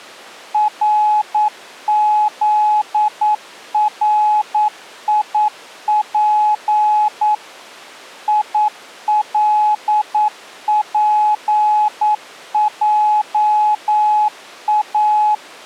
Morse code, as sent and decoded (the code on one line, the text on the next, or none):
.-. --.. .-. .. .--. / .. .-.. .--. .--- .-
RZRIP ILPJA